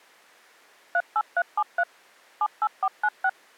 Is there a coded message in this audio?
Yes: DTMF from 0.9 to 3.3 s, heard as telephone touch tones, dialled by machine, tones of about 60 ms. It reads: 38373 78496